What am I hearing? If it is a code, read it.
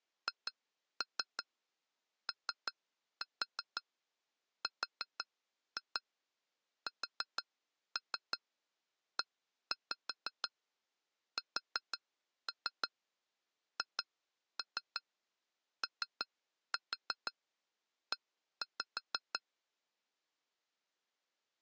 Tap code, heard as taps on glass, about 5 knocks a second. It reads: HORSESHOE